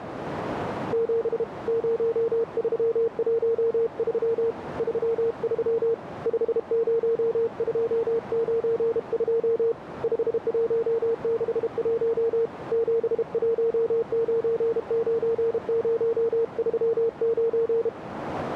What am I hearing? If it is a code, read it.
Morse code, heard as a keyed tone, hand-sent with a paddle, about 32 wpm, 460 Hz, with radio static and a narrow filter. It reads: 7 0313 33 50292 5161 7199039